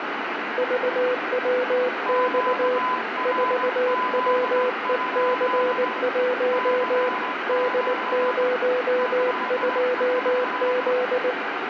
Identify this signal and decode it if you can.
Morse code, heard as two keyed tones, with radio static and room echo. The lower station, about 19 wpm, 500 Hz: VWX 4WEC1 D02Z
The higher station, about 17 wpm, 1010 Hz: QRZ? CQ CQ